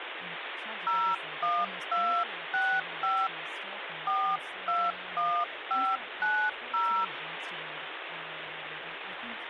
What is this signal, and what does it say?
DTMF, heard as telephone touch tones, dialled by hand, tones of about 270 ms, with phone line noise and speech in English. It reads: 01265 421590